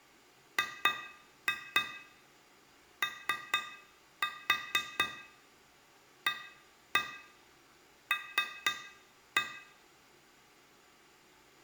Tap code, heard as taps on glass, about 4 knocks a second, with room echo. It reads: GOAL